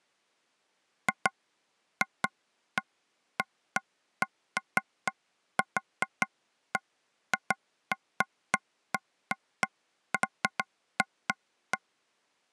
Irregular taps on a table. There is no code.